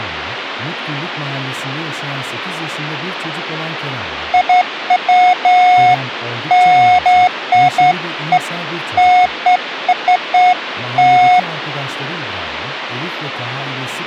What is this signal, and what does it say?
Beeps of irregular length, with phone line noise and speech in Turkish. There is no code.